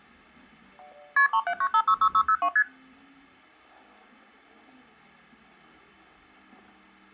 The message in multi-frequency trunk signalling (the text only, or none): KP 379566602 ST